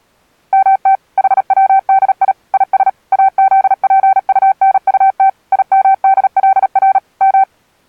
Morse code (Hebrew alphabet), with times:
0.5-1.0 מת
1.2-2.3 חצדי
2.5-2.9 יש
3.1-5.3 אזפטנטת
5.5-7.0 ימדלר
7.2-7.4 מ

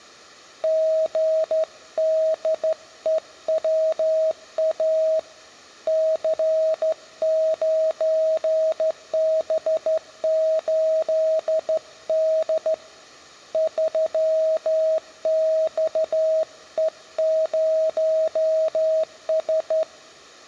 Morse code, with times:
0.6-5.2 GDEWA
5.9-12.7 C9B8D
13.5-19.8 3XE0S

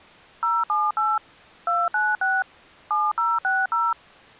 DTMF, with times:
0.4-1.2 078
1.7-2.4 296
2.9-3.9 7060

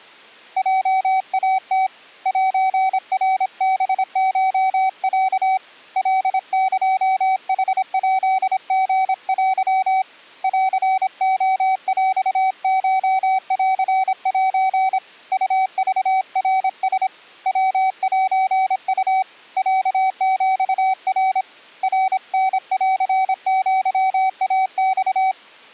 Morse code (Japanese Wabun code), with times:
0.6-1.9 ヲイム
2.3-5.6 セナハコロ
6.0-10.0 カエヌヱリテ
10.4-15.0 ンレヰコンセ
15.3-17.1 ウクナラ
17.5-19.2 ヤセウ
19.6-21.4 ロヒナ
21.8-25.3 ナタンアイマ

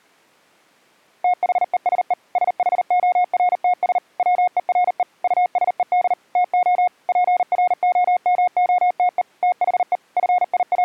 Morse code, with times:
1.2-2.1 THESE
2.4-4.0 SHORTS
4.2-5.0 WERE
5.2-6.1 USED
6.4-6.9 TO
7.1-9.2 PROMOTE
9.4-10.0 THE
10.2-10.8 …

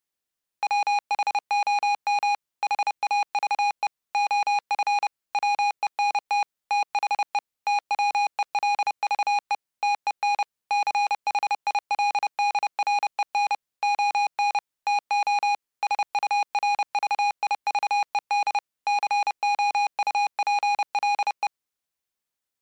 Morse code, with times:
0.6-2.3 WHOM
2.6-3.9 HAVE
4.1-5.1 OF
5.3-6.4 WENT
6.7-7.4 THE
7.7-9.5 TWELVE
9.8-10.4 TEN
10.7-13.5 CHILDREN
13.8-14.6 ON
14.9-15.5 TO
15.8-18.6 SURVIVED
18.9-21.5 COUPLE

